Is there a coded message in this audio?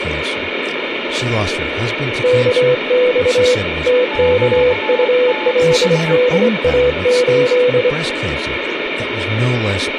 Yes: Morse code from 2.2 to 8.0 s, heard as two keyed tones, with radio static and speech in English. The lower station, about 24 wpm, 500 Hz: KX TKULDA8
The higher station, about 20 wpm, 870 Hz: QTH